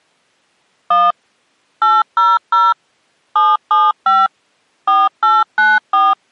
DTMF, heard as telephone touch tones, dialled by machine, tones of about 200 ms. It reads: 1 800 775 4894